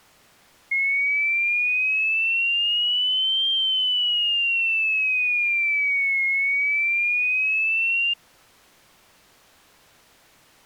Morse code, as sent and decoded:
none

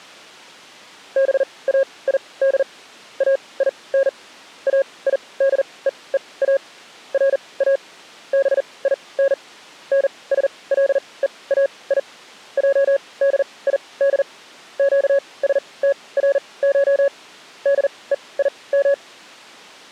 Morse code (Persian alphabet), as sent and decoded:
-... .- .. -.. / .- .. -. / .- .. -.. . . .- / .-. .- / -... .. -. / -. ... .-.. . .- .. / .--- -.. .. -.. / --.- ... - .-. ---- / -.. . .. --
باید این ایدهها را بین نسلهای جدید گسترش دهیم

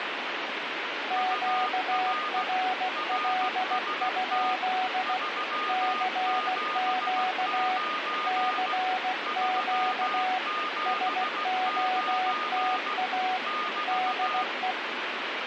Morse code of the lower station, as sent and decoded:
--.- .-. .-.. ..--.. / -.-. --.- / -.-. --.- / ... --- - .- / -.. .
QRL? CQ CQ SOTA DE

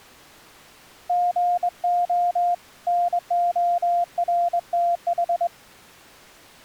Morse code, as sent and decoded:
--. --- / -. --- .-. - ....
GO NORTH

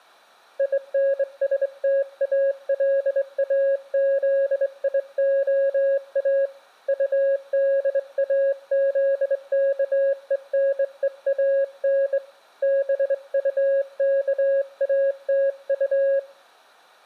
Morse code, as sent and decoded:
.. -. ... - .- .-.. .- --.. .. --- .- / ..- -.. .- --.. -.- . -. . .- -. / -... ..- -.- .- - ..-
INSTALAZIOA UDAZKENEAN BUKATU

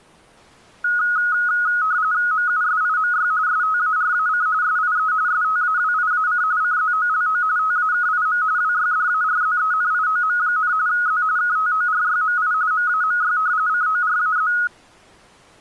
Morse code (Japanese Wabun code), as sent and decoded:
none

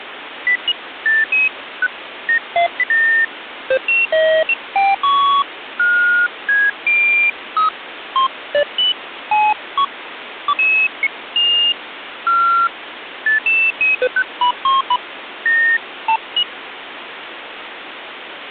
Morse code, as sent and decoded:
none

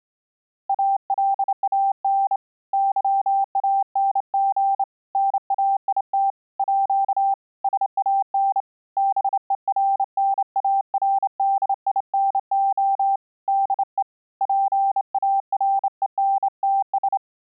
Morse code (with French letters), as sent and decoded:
.- .-.. .- -. / -.-- .- -. --. / -. .- .. - / .--.- / ... .- -. / -... . .-. -. .- .-. -.. .. -. --- / -.. . / .--. .- .-. . -. - ...
ALAN YANG NAIT À SAN BERNARDINO DE PARENTS

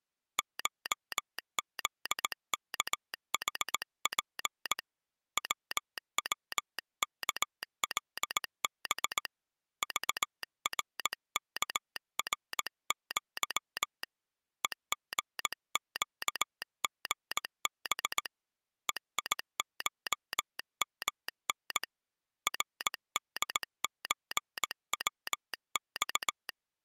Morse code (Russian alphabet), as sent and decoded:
---- --.. -.- .... .--. / .-- .-- -.- .-.. -... / ...- .-. -.- .-. --.-- / . --. --.- --. -... / . .. ---- -- -. / .-. -.. ---. .-- -..-
ШЗКХП ВВКЛБ ЖРКРЪ ЕГЩГБ ЕИШМН РДЧВЬ

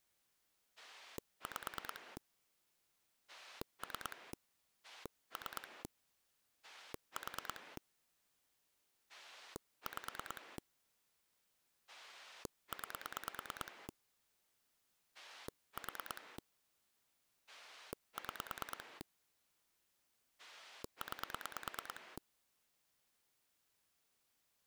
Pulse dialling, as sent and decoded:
5 / 3 / 3 / 4 / 5 / 9 / 4 / 6 / 9
5 3 3 4 5 9 4 6 9

